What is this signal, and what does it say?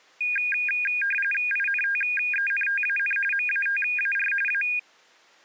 RTTY (45.45 baud, 850 Hz shift), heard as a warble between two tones, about 2050 Hz centre. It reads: INTENTAN MATAR A